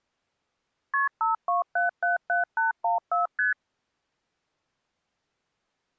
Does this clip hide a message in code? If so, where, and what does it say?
Yes: multi-frequency trunk signalling (R1, as on North American trunks) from 0.9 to 3.5 s, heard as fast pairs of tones, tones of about 140 ms. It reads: KP 52777814 ST